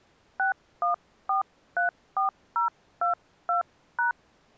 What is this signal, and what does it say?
DTMF, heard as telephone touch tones, dialled by hand, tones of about 120 ms. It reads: 61434022#